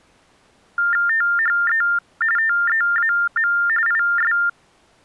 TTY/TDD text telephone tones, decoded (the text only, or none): THE TEAM IS